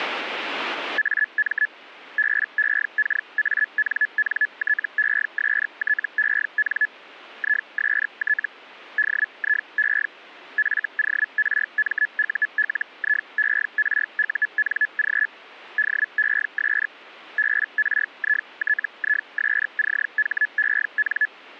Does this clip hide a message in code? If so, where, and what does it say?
Yes: Hellschreiber (Feld-Hell, 122.5 baud) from 1.0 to 21.3 s, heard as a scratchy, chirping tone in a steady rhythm, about 1700 Hz. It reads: AM BEKANNTESTEN IST DIE FORMULIERUNG DES BRITISCHEN